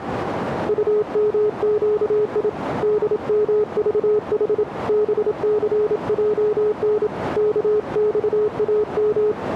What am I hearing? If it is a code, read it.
Morse code, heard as a keyed tone, hand-sent with a paddle, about 27 wpm, 420 Hz, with radio static and a narrow filter. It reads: UMQI DMVH BCJN KXAM